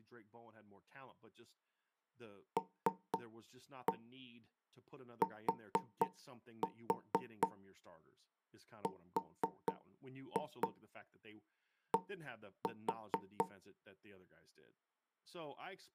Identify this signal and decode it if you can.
Tap code, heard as knocks on wood, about 4 knocks a second, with speech in English. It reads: LTRD